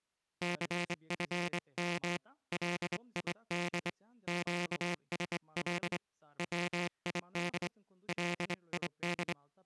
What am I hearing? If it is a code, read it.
Morse code, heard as a buzzer, hand-sent with a straight key, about 24 wpm, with speech in English. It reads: CFM LID QSL WID LID